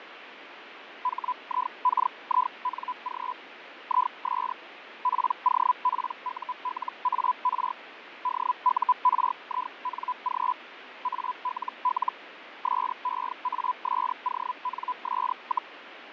Hellschreiber (Feld-Hell, 122.5 baud), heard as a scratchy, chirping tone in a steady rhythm, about 1000 Hz, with radio static and fading. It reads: HIKING IS POPULAR DURING ALL SEASONS,